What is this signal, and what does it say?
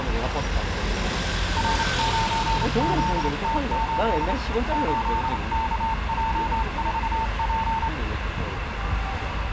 Morse code, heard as a keyed tone, hand-sent with a straight key, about 28 wpm, 900 Hz, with radio static, room echo and street noise. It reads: R9ZT8 8KJ4P